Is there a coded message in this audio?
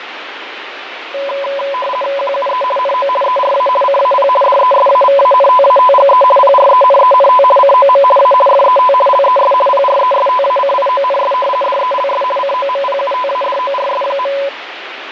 Yes: RTTY (50 baud, 450 Hz shift) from 1.1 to 14.5 s, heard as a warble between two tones, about 780 Hz centre, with radio static and fading. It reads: QUE NO ERA CAP DESAVANTATGE PRENENT COM A FET LES PRESTACIONS DELS COMPUTADORS.